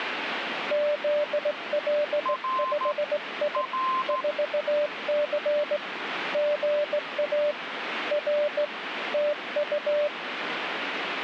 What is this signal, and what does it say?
Morse code, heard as two keyed tones, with radio static. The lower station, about 17 wpm, 590 Hz: ZL5I 4C GA R TU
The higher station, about 13 wpm, 1040 Hz: R R